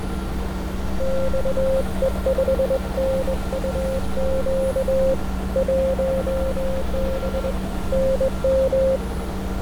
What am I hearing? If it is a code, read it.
Morse code, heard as a keyed tone, hand-sent with a straight key, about 21 wpm, 530 Hz, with radio static, fading and street noise. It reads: XE5NUQ 1B NM